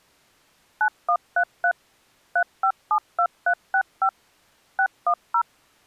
DTMF, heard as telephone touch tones, dialled by machine, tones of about 80 ms. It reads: 9133 3572365 610